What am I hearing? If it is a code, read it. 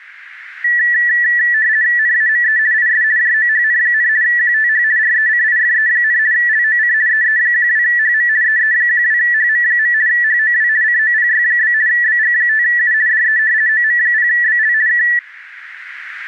RTTY (50 baud, 170 Hz shift), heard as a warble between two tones, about 1850 Hz centre. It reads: NAME IS JOHN, QTH RECIFE, LOC EE12HM EE12HM. HOW COPY? BG5U DE OM0BL K